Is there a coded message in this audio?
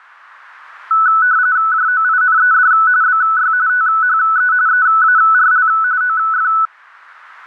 Yes: RTTY (45.45 baud, 170 Hz shift) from 0.9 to 6.7 s, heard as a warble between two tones, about 1400 Hz centre. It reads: JOINED BY THE EARL OF